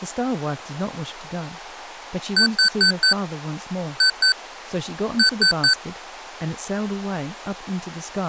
Beep code, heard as beeps from a small speaker, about 1500 Hz, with speech in English. 4-2-3. In Phoenix BIOS tables: gate A20 failure.